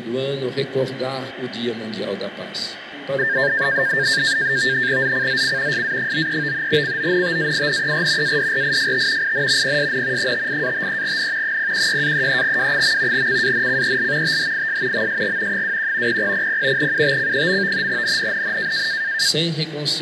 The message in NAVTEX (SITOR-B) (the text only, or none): ZCZC SA93 CONTAINER ADRIFT IN PSN 58-53N 016-33W. CANCEL THIS MSG 21 0000 UTC. NNNN